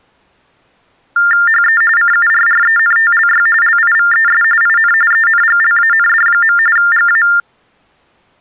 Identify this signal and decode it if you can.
TTY/TDD text telephone tones (45.45 baud Baudot), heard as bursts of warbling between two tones, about 400 Hz shift, 1600 Hz centre. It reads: HE CURRENTLY LIVES IN ENGLAND. GA